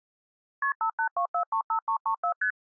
Multi-frequency trunk signalling (R1, as on North American trunks), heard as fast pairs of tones, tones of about 90 ms. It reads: KP 582435334 ST